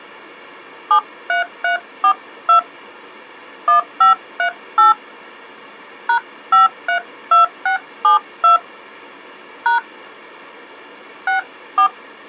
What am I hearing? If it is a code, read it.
DTMF, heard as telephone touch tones, dialled by hand, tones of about 110 ms. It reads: 73342 1538 #532672 # 64